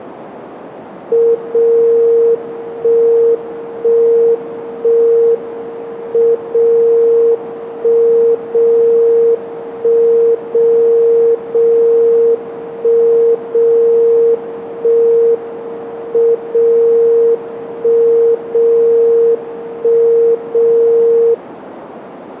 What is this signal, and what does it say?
Radio time signal (WWVB), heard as a tone whose level steps once a second, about 460 Hz, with radio static. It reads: 0 1 1 1 M 0 1 0 1 0 0 1 0 1 M 0 1 0 1 0